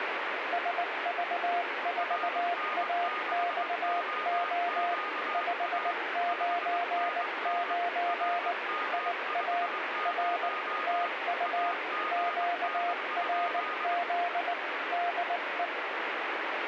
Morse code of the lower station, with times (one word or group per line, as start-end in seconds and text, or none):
0.5-4.9 SV4AXO
5.3-8.5 599
8.9-9.7 IA
10.1-10.5 R
10.9-11.7 TU
12.1-14.5 QRZ
14.9-15.7 DE